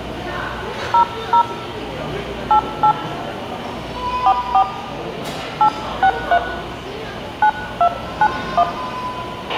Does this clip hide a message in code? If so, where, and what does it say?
Yes: DTMF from 0.9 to 8.6 s, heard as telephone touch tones, dialled by hand, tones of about 70 ms, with a squelch burst at the end and the noise of a restaurant. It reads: 00 88 44 863 9291